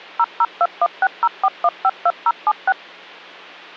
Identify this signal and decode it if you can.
DTMF, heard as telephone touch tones, dialled by machine, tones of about 50 ms, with hum. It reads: 0021604152076